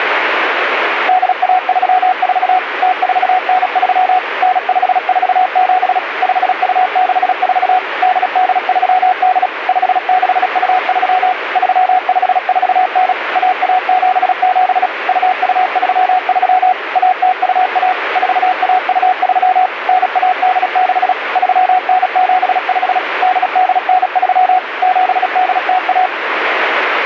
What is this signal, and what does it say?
Morse code (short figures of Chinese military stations), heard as a keyed tone, machine-sent, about 36 wpm, 740 Hz, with radio static. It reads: 8134 0493 9547 5264 8838 5623 3549 1177 2233 1021 4123 9186 3975 8893 7801